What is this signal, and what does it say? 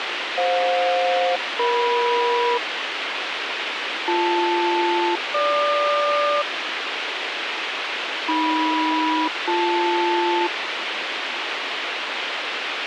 Aircraft SELCAL, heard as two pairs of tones, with radio hiss. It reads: FJ-EM BL-GQ AM-BL